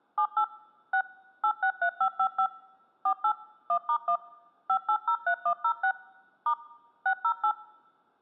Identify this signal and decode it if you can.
DTMF, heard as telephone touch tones, dialled by machine, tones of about 80 ms. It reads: 78 6 863555 48 1*1 5803106 * 608